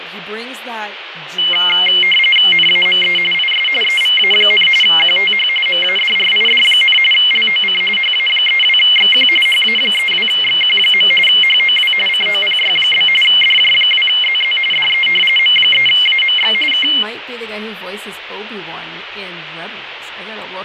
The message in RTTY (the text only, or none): NAME IS EVA, QTH MADRID, LOC HA32XQ HA32XQ. HOW COPY? DJ2ZZ DE M3AMX K